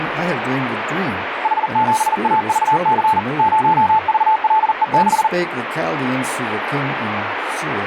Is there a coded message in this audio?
Yes: Morse code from 1.4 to 5.3 s, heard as a keyed tone, hand-sent with a paddle, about 40 wpm, 870 Hz, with radio static. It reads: H7AVC 0VLE6